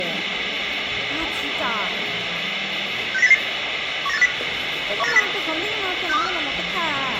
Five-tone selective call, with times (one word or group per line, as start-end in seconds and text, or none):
3.1-3.3 69088
4.1-4.3 19850
5.0-5.2 19850
6.1-6.3 62345